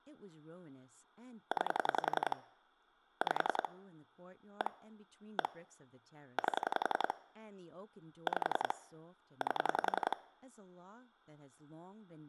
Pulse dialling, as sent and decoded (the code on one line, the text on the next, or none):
9 / 5 / 1 / 1 / 8 / 5 / 8
9 5 1 1 8 5 8